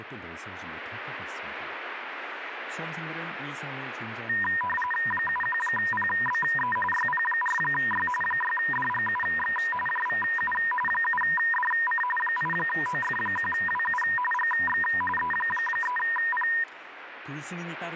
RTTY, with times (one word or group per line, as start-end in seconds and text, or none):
5.1-6.8 71PBE
6.9-8.1 YP4Y
8.2-9.6 6DGUX
9.9-10.5 JVU
10.9-12.0 7DC
12.2-14.0 8OF1WU
14.3-14.8 GX
15.2-16.5 E3P